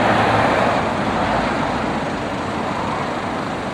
Street noise. There is no code.